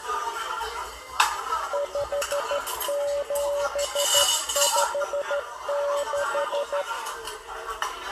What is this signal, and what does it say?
Morse code, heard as a keyed tone, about 13 wpm, 570 Hz, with room echo and the noise of a crowd indoors. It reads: 5756